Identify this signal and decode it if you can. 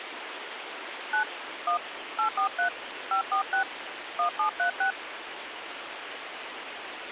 DTMF, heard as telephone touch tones, dialled by hand, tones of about 100 ms, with phone line noise. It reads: 9 1 843 546 1736